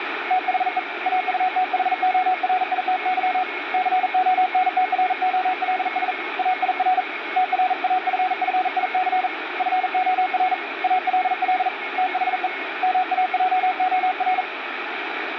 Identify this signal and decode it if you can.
Morse code, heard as a keyed tone, hand-sent with a paddle, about 40 wpm, 740 Hz, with radio static and a weaker station near 2180 Hz. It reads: THE AUTHORITY CONTROLS AIR TRAFFIC FOR ALL THE MAJOR